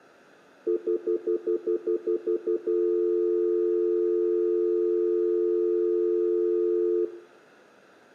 Telephone call progress tone (North American plan), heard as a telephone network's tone, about 350, 440 Hz, 0.1 s on and 0.1 s off, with room echo. Stutter dial tone.